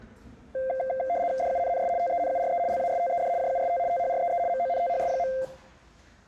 RTTY (75 baud, 170 Hz shift), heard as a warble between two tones, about 610 Hz centre, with the noise inside a lift. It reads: DUNNS TENURE LASTED JUST THREE MONTHS.